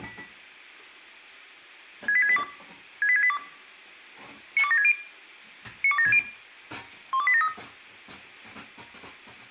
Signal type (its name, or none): five-tone selective call